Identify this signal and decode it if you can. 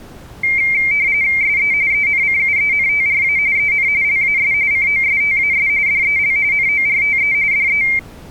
RTTY (45.45 baud, 170 Hz shift), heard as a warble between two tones, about 2200 Hz centre. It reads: SE ENCUENTRA EN LAS COSTAS DEL NORTE DE